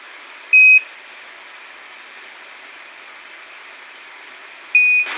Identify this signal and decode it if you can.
Quindar tones, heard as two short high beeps, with a squelch burst at the end.